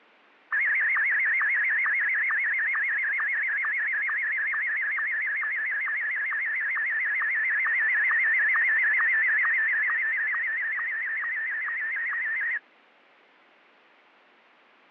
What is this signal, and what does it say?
SSTV (slow-scan television), Martin M1, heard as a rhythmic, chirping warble.